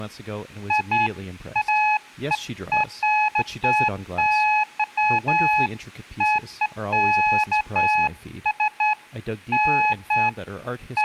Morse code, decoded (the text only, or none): none